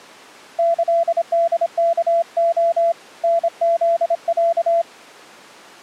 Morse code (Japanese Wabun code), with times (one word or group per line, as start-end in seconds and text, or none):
0.6-2.9 キホワレ
3.2-4.8 タフロ